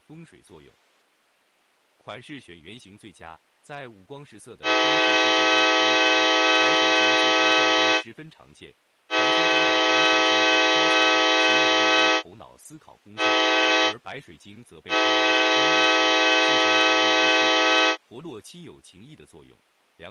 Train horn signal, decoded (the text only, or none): 2 long, 1 short, 1 long